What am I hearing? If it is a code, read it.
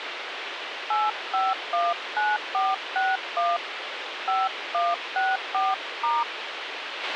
DTMF, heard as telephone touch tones, dialled by hand, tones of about 200 ms, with radio hiss and a squelch burst at the end. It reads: 8519461 5164*